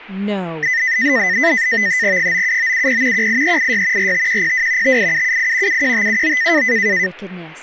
NAVTEX (SITOR-B), 100 baud, 170 Hz shift, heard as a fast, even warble, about 1900 Hz centre, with speech in English. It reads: 97970 18386 45102 58778 71579